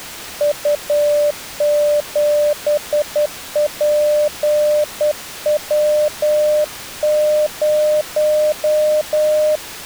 Morse code, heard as a keyed tone, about 10 wpm, 600 Hz. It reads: U7PW0